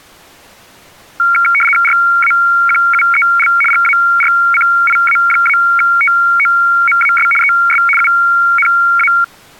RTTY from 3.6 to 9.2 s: GARCIA-TOMAS ES UNA

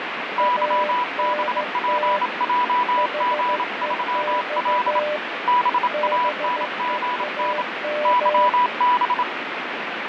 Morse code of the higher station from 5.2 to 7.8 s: BANGN

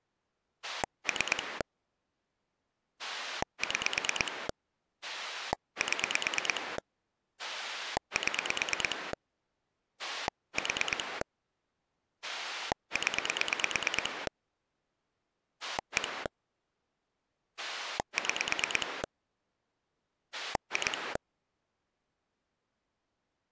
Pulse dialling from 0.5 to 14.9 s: 3 6 7 7 4 0

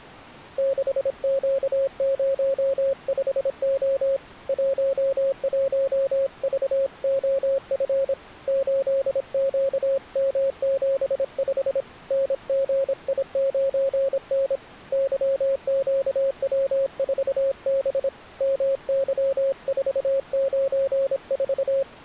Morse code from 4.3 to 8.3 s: 11VOF

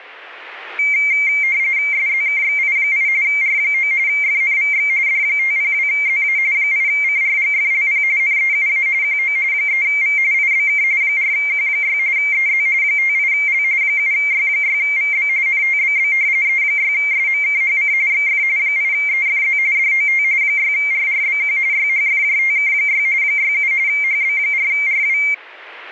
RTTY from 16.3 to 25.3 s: E6SMKHC XF 8EFZ DOT 6RRBQ YHFJTK6 67 HB4RW

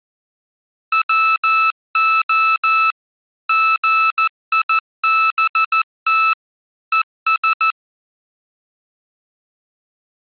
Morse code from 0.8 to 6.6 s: WO GIBT

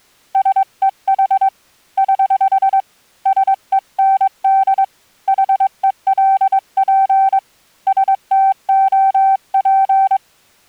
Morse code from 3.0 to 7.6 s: SEND HELP

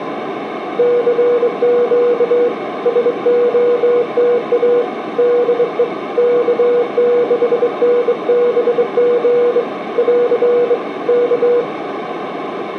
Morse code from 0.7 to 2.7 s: CQ

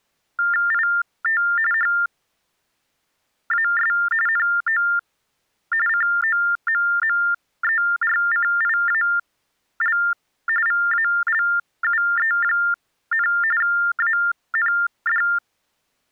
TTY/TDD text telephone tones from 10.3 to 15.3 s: VALUE, AND

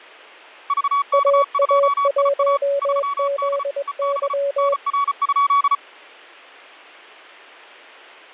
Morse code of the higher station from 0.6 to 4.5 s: VK2IA 3D EB

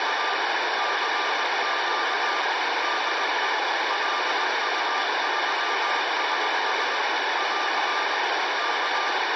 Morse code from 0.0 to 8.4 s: … CQ DE LU3SS <AR>

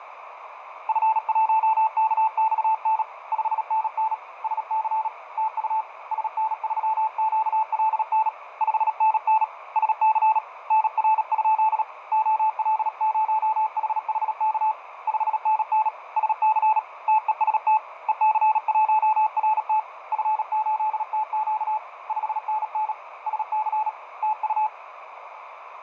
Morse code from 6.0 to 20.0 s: SN3QLN 5NN SC NR? OL0HHK 5NN SC TEST EC1RT

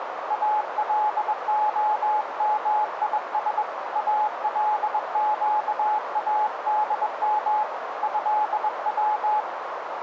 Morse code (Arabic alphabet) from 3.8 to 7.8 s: القادم

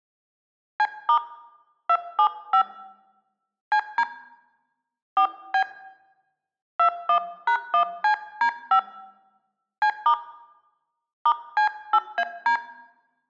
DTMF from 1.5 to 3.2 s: 275

